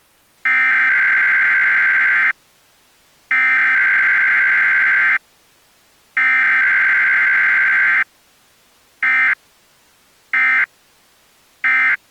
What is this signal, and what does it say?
Emergency Alert System (SAME) tones (header bursts, then end-of-message bursts), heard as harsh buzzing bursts, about 520.83 baud.